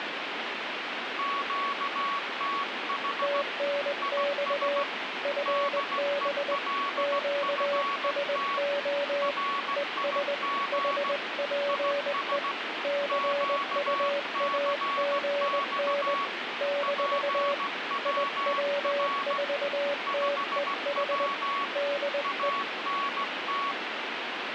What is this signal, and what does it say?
Morse code, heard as two keyed tones, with radio static. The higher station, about 16 wpm, 1120 Hz: QTH IS DELFT RIG IS QCX PWR 5W ANT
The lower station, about 20 wpm, 570 Hz: TNX FB QSO ES HPE CUAGN - IW4TEH DE